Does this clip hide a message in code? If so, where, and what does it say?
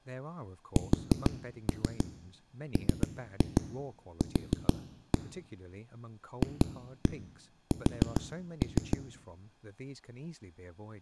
Yes: tap code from 0.8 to 9.0 s, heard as knocks on a wall, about 6 knocks a second, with speech in English. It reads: SMQ FS